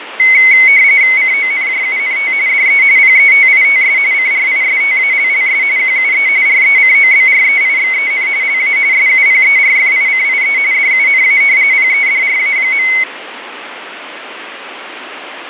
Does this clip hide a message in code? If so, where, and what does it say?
Yes: RTTY (45.45 baud, 170 Hz shift) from 0.2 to 13.0 s, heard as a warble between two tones, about 2150 Hz centre, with radio static and fading. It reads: CONJUNT DE PETITS CRISTALLS QUE RECOBREIXEN LA SUPERFICIE DUNA PEDRA.